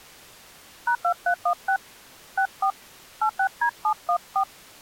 DTMF, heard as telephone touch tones, dialled by hand, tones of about 80 ms. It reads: #2316 64 86D714